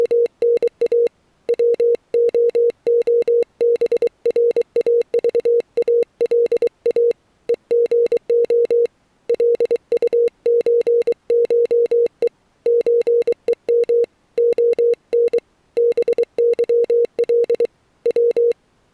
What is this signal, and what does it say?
Morse code (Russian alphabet), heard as a keyed tone, hand-sent with a paddle, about 23 wpm, 470 Hz. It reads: … ВООБРАЖАЛА ЕГО ЛУЧШЕ ЧЕМ ОН БЫЛ В